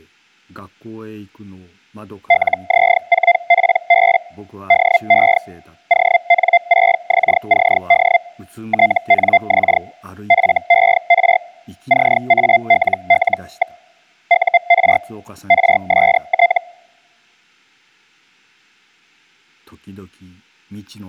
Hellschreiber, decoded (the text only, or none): LZ4PB DE ON6XCD TNX FER CALL. UR RST